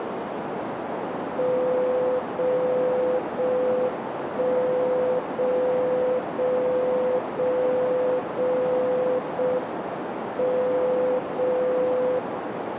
Radio time signal (JJY), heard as a tone whose level steps once a second, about 510 Hz, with radio static and a narrow filter. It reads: 0 0 1 0 0 0 0 0 M 0 0